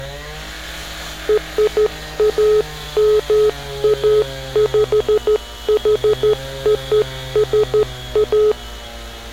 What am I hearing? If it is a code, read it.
Morse code (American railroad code), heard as a keyed tone, hand-sent with a straight key, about 430 Hz, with street noise. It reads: RAMAPHOSA